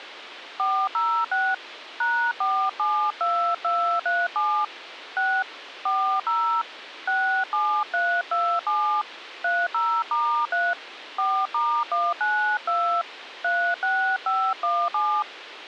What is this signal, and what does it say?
DTMF, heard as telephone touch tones, dialled by hand, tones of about 300 ms, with radio hiss. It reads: 406 #472237 6 40 67327 30*3 4*192 36517